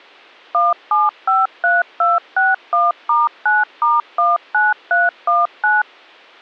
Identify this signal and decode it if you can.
DTMF, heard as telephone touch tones, dialled by machine, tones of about 180 ms. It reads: 1753261*9*19319